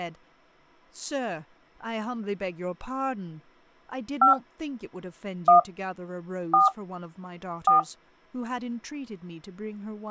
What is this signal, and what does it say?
DTMF, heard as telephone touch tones, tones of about 150 ms, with speech in English. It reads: 5 1 4 4